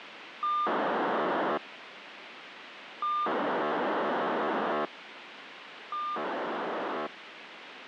POCSAG pager data (2400 baud), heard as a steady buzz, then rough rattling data, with radio hiss.